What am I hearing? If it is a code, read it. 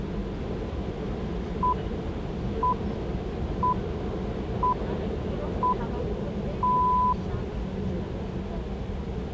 Radio time signal (six pips, as the Greenwich Time Signal), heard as pips, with the noise inside a subway train.